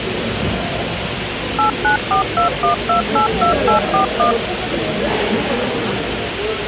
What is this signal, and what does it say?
DTMF, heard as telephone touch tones, dialled by machine, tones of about 120 ms, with radio hiss and the noise of a crowd indoors. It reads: 89421282841